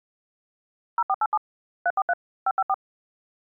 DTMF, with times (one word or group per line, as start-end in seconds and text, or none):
1.0-1.4 0487
1.9-2.1 343
2.5-2.7 554